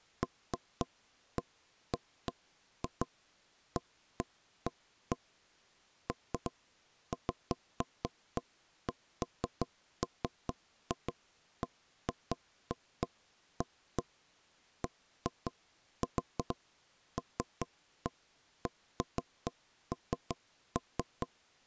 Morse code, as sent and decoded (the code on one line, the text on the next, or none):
none